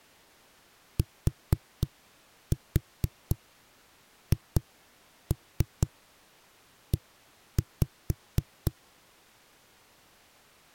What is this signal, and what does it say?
Tap code, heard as knocks on a wall, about 4 knocks a second. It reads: THE